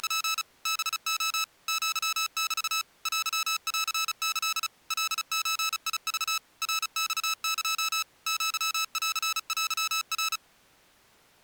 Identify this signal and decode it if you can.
Morse code (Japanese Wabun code), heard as electronic beeps, machine-sent, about 35 wpm, 1310 Hz. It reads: … ハレ アメ テンキ カゾク ナマエ アンテナ